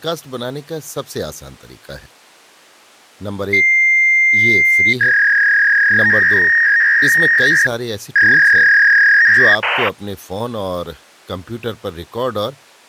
Fax machine handshake, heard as a long tone and a warble, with speech in Urdu.